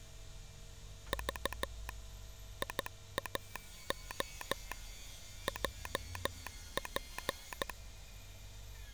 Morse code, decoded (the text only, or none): V IAO JP